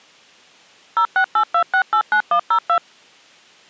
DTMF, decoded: 0682689102

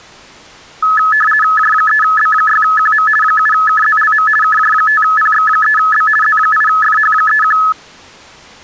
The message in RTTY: J3B6QM 7KZLM KJ5PX3B Z8FH31

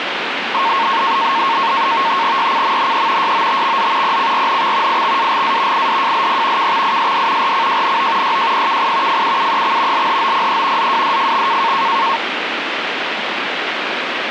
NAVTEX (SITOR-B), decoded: YCMNE YOTXZ PCRNX IXAGA IDJLP KXISD RCJNO YJPKI FUUEX LHOPE ZWDFX

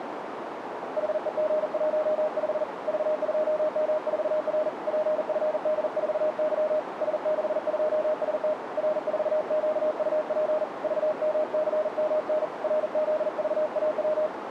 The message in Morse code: HEG15 V2M4R PFD4Y S62ST R4QUP VMCMN RZVAW

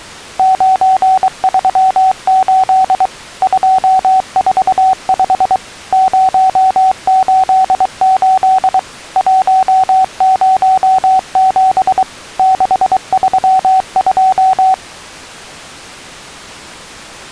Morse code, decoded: 938 245 088 107 632

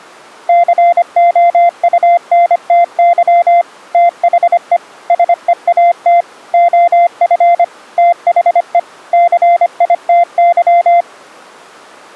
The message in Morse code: COUNTY THE SEAT OF THE CITY

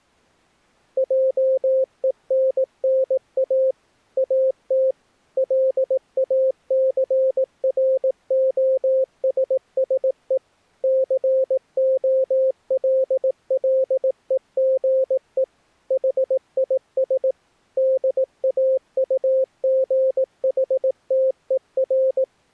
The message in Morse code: JENNA AT LACROSSE COLLEGE HIS DAUGHTER

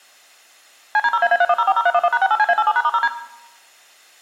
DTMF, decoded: CD0AA31040311#68CA87#*0D

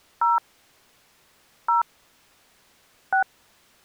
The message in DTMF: 0 0 6

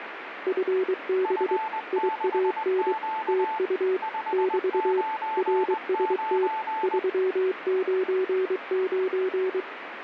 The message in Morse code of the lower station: FB IAN TU <BT> RST 399

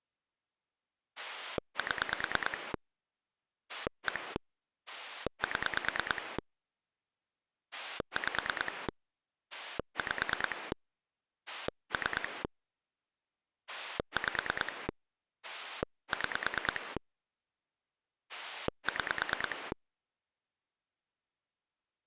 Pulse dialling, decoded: 7 1 7 5 5 3 5 6 6

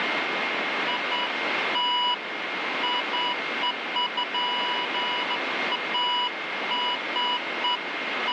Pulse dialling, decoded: none

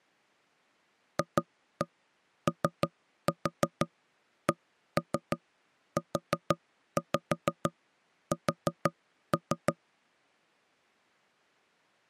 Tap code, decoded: FOCUS

